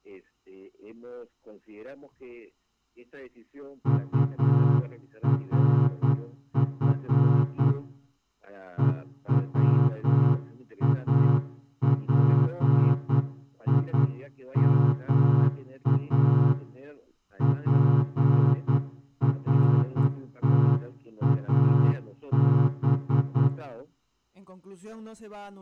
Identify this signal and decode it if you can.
Morse code (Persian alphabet), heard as a horn, hand-sent with a straight key, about 9 wpm, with room echo. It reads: طرف هواپیما پرتاب